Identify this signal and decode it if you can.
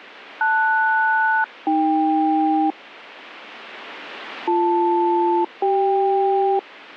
Aircraft SELCAL, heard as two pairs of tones. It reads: LS-AK BL-CK